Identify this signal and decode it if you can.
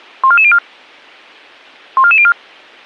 Five-tone selective call (ZVEI), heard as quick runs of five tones, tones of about 70 ms. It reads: 14404 14404